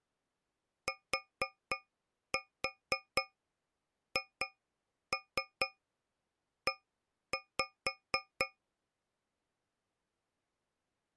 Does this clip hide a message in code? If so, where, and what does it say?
Yes: tap code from 0.9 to 8.6 s, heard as taps on a metal pipe, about 4 knocks a second. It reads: THE